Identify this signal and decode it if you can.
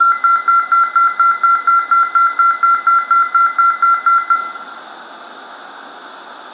A tone that alternates evenly between two pitches, with room echo. There is no code.